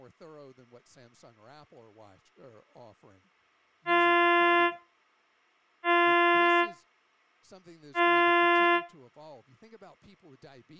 Ship horn signal, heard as a ship's horn, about 350 Hz, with speech in English. 3 short. At sea: I am operating astern propulsion.